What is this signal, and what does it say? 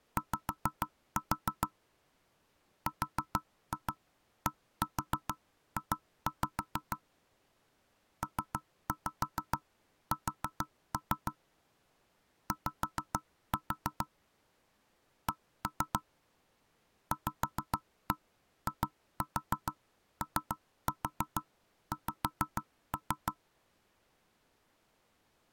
Tap code, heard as knocks on wood, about 6 knocks a second. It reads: Y RDJ PS Y C VIOX